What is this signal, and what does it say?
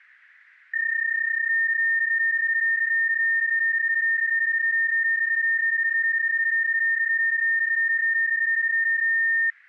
PSK31 (31.25 baud), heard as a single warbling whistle, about 1800 Hz.